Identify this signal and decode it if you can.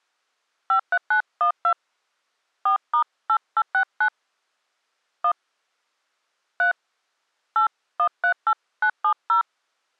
DTMF, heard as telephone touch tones, dialled by hand, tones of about 80 ms. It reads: 53912 4*8869 1 3 8138970